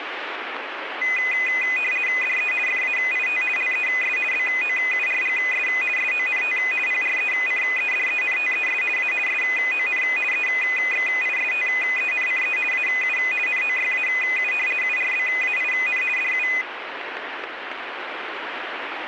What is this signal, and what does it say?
RTTY (50 baud, 450 Hz shift), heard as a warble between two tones, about 2250 Hz centre, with radio static. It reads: DE FAIT LES BOURGS SONT PRECEDENTES A SON EXISTENCE AU NOYAU URBAIN DU